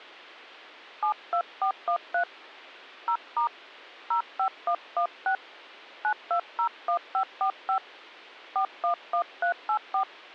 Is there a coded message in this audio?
Yes: DTMF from 1.0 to 10.0 s, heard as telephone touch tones, dialled by hand, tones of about 90 ms. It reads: 72413 0* 05116 9201545 411384